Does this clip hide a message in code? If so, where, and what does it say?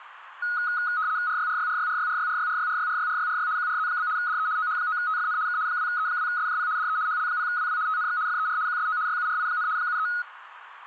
Yes: RTTY (75 baud, 170 Hz shift) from 0.4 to 10.2 s, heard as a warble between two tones, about 1360 Hz centre, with radio static. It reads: RYRYRYRYRYRYRYRYRYRYRY QRZ? DE OH9TFN K 2E2SJP DE HL0WW TNX FER QSO YURI, 73